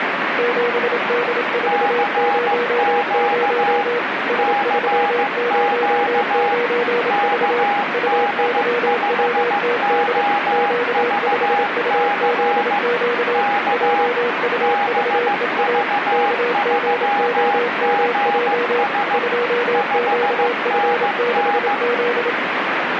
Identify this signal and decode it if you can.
Morse code, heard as two keyed tones, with radio static. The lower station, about 27 wpm, 480 Hz: 7D400 S309V UYWTD Q5UZQ JUVEA KGOMJ 2QF6Z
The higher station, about 15 wpm, 820 Hz: CQ CQ KD5OVC K BV3GS 5NN